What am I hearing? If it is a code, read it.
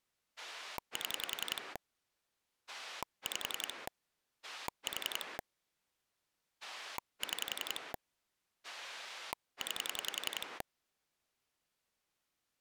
Pulse dialling, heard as a rotary dial, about 11 pulses a second. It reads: 7 5 4 6 9